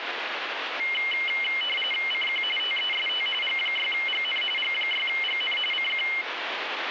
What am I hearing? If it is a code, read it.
RTTY (45.45 baud, 850 Hz shift), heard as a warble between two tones, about 2550 Hz centre, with radio static. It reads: CQ TEST G6GN G6GN CQ